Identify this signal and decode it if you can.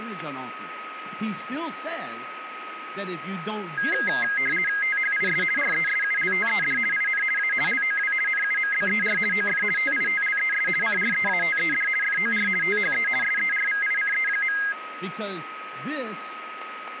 RTTY (50 baud, 450 Hz shift), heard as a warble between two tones, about 1850 Hz centre, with radio static, a steady whistle near 1270 Hz and speech in English. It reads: THIS RESULTED IN A LOW NUMBER OF TITLES CREATED FOR THE SERVICE.